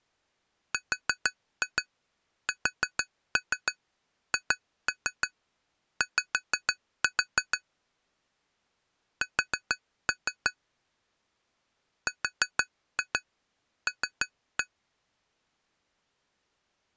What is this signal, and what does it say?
Tap code, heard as taps on glass, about 6 knocks a second. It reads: RSHY S RL